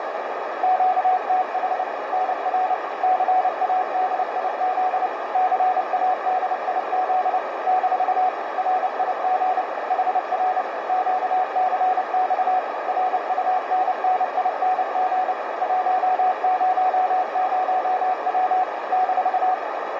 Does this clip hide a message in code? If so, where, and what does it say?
Yes: Morse code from 0.6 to 19.6 s, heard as a keyed tone, machine-sent, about 29 wpm, 740 Hz, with heavy radio static and a narrow filter. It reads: QTH NR CADIZ CADIZ - RIG HR QCX RUNNING 100W -